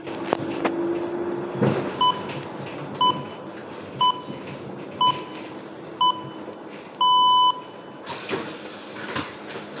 Radio time signal (six pips, as the Greenwich Time Signal), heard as pips, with room echo and the noise inside a bus.